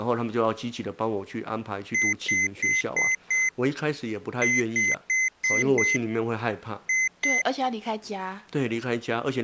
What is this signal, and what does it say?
Beep code, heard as beeps from a small speaker, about 2050 Hz, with speech in Chinese. 5-5-2.